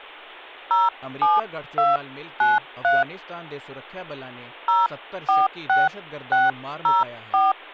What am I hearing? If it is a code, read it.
DTMF, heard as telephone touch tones, dialled by hand, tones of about 180 ms, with speech in Punjabi. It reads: 07293 046604